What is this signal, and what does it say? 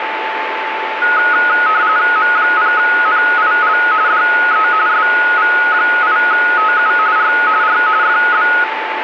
RTTY (45.45 baud, 170 Hz shift), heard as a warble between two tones, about 1360 Hz centre, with radio static and a steady whistle near 880 Hz. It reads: M0NIL DE SV8TU R R FB